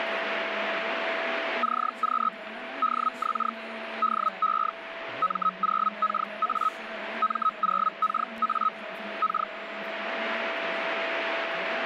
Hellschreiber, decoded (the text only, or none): CQ DX DE M0KA M0KA K